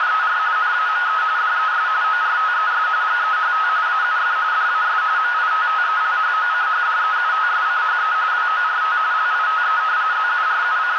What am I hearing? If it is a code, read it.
RTTY (45.45 baud, 170 Hz shift), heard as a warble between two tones, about 1360 Hz centre, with radio static and a narrow filter. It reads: … NAME DES ORTES GEHT AUF DAS MITTELHOCHDEUTSCHE WORT LITE …